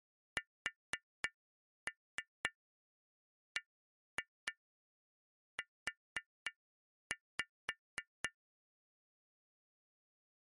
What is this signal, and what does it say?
Tap code, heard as taps on glass, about 4 knocks a second. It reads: SBU